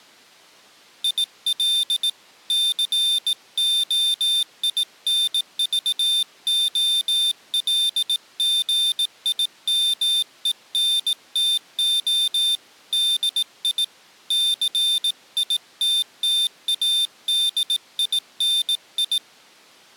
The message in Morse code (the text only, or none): IL COINVOLGIMENTO DI CITTADINI